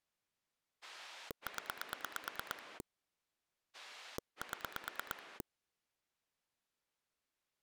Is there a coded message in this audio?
Yes: pulse dialling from 0.8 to 5.4 s, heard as a rotary dial, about 9 pulses a second. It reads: 0 7